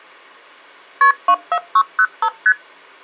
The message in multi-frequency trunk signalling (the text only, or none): KP 24605 ST